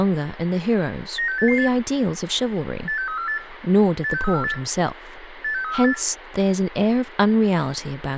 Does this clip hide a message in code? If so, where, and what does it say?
Yes: five-tone selective call (CCIR) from 1.2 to 5.9 s, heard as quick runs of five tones, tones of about 100 ms, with radio hiss, room echo and speech in English. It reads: 96888 86348 86348 86348